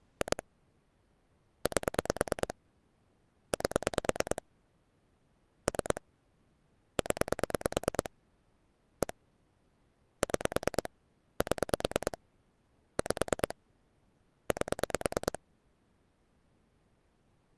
Pulse dialling, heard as clicks on a phone line, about 9 pulses a second. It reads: 2 8 8 3 0 1 6 7 5 8